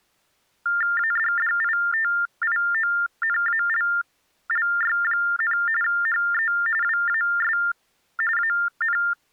TTY/TDD text telephone tones (45.45 baud Baudot), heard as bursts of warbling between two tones, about 400 Hz shift, 1600 Hz centre. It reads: ADDITIONALLY, HE WAS AN